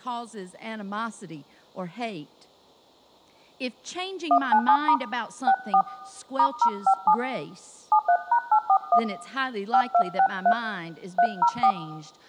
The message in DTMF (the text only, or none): 197* 64 *057 73#841 5263 304